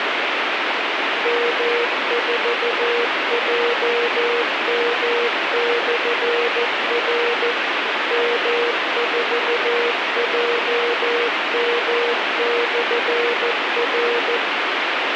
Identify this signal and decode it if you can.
Morse code, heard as a keyed tone, machine-sent, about 14 wpm, 480 Hz, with radio hiss and a squelch burst at the end. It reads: M4JM/R M4JM/R